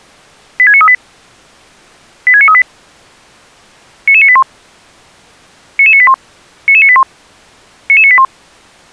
Five-tone selective call (ZVEI), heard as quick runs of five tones, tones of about 70 ms. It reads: 86938 86938 99981 99981 99981 99981